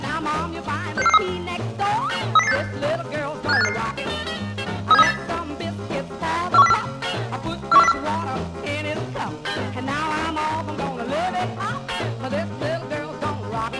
Five-tone selective call (EEA), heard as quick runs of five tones, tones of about 40 ms. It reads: 66443 30086 57855 37308 41404 41404